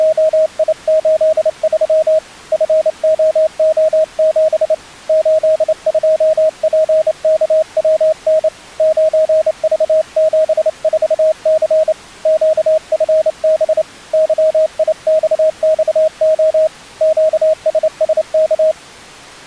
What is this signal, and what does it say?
Morse code, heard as a keyed tone, hand-sent with a straight key, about 28 wpm, 630 Hz. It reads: … FOO7 82PKWN 9V74C QFB YIXXO QSSK